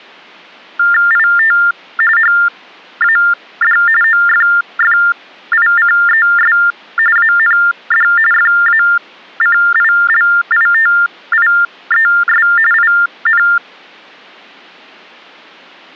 TTY/TDD text telephone tones (45.45 baud Baudot), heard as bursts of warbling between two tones, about 400 Hz shift, 1600 Hz centre. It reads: IT HAD OFFICES AND FACILITIES IN